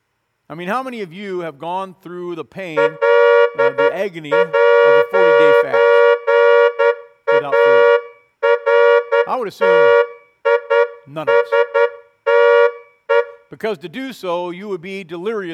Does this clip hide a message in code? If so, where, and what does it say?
Yes: Morse code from 2.7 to 13.3 s, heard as a horn, hand-sent with a straight key, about 10 wpm, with room echo and speech in English. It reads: L'ARTISTE